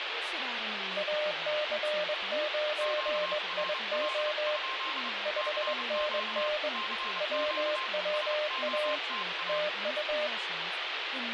Morse code, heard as two keyed tones, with radio static and speech in English. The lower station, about 21 wpm, 600 Hz: AC9IO 5NN WWA TU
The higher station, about 29 wpm, 1060 Hz: QRL? CQ CQ SOTA